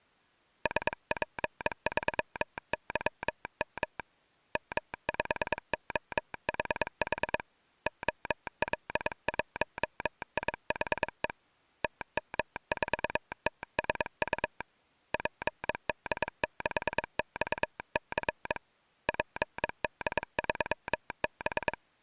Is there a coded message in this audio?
Yes: Morse code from 0.6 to 21.8 s, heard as a telegraph sounder, hand-sent with a paddle, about 22 wpm. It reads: SP3YM M5OHH OL1IHE TM4TSU PD6XC PD3B